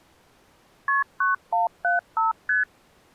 Multi-frequency trunk signalling (R1, as on North American trunks), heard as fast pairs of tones, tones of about 150 ms. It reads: KP 9175 ST